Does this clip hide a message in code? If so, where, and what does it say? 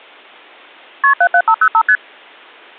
Yes: multi-frequency trunk signalling (R1, as on North American trunks) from 1.0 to 2.0 s, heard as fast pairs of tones, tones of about 70 ms. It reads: KP 77505 ST